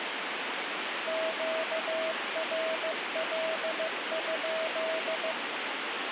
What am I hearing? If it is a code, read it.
Morse code, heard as a keyed tone, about 15 wpm, 640 Hz, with heavy radio static. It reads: QRL?